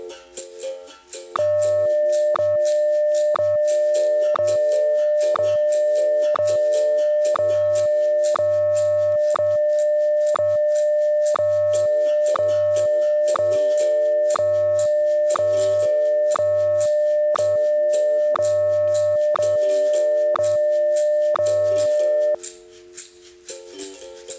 Radio time signal (WWVH, Hawaii), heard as ticks, one a second.